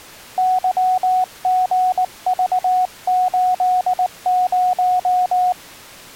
Morse code, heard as a keyed tone, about 19 wpm, 740 Hz. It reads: YGV80